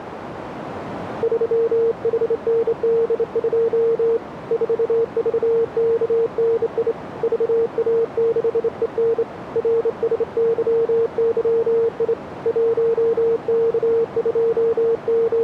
Morse code, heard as a keyed tone, hand-sent with a straight key, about 27 wpm, 460 Hz, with radio static and a narrow filter. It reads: 3HND2 4VKNI VA6EN RSYYI …